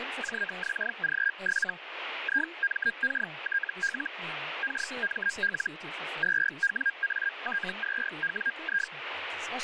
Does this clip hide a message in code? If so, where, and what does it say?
Yes: Hellschreiber (Feld-Hell, 122.5 baud) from 0.2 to 8.9 s, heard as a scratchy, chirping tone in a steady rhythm, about 1600 Hz, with radio static and speech in Danish. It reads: JXG7 IMKTL KML 2WAT2WI